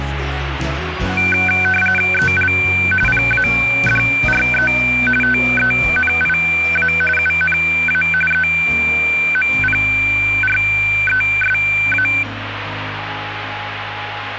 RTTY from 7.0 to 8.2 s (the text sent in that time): UNA